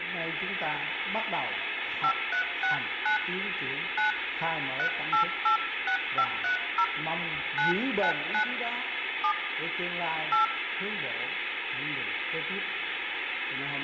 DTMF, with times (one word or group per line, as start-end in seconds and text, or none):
2.0-3.2 5369
4.0-4.1 9
4.8-6.8 3886530
7.6-8.4 999
9.2-9.3 7
10.3-10.4 8